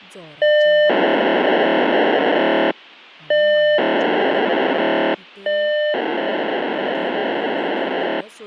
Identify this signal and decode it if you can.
POCSAG pager data (1200 baud), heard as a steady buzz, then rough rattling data, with speech in Goan Konkani.